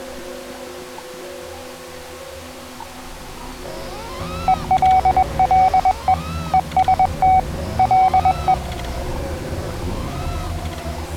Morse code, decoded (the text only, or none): ELLE EST LE